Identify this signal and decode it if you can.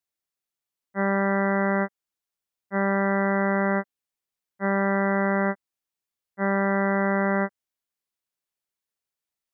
Ship horn signal, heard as a ship's horn, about 200 Hz. 4 short. At sea: a pilot vessel's identity signal in fog.